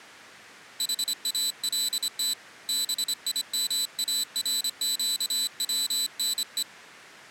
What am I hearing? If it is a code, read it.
Morse code (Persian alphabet), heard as a high beeper, hand-sent with a straight key, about 26 wpm, 4000 Hz. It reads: حالت بیمارگونه